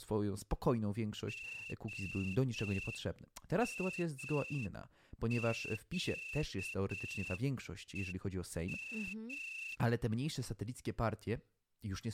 Morse code (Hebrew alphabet), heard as a whistle, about 7 wpm, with speech in Polish. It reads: המקום